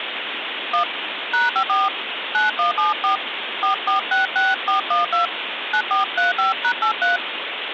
DTMF, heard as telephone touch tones, dialled by hand, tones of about 130 ms, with phone line noise. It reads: 1 #54 9174 4466412 9435#83